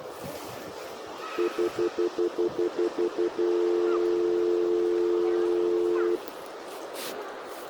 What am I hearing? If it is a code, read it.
Telephone call progress tone (North American plan), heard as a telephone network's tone, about 350, 440 Hz, 0.1 s on and 0.1 s off, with the noise of a residential street. Stutter dial tone.